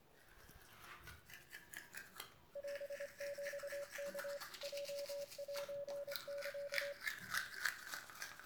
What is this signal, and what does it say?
Morse code (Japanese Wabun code), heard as a keyed tone, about 25 wpm, 570 Hz, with room echo and the noise of a restroom. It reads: オヒワ ヲセサ